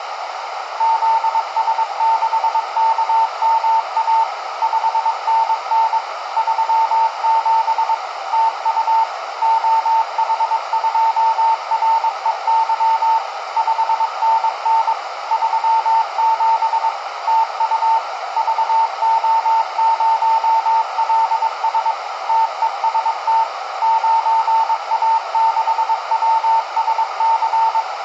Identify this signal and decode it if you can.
Morse code, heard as a keyed tone, machine-sent, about 22 wpm, 900 Hz, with radio static and a narrow filter. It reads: ZS6KMA 5NN 37 TU OH2REY 5NN 37 TU VO0LS TEST 9A6WSC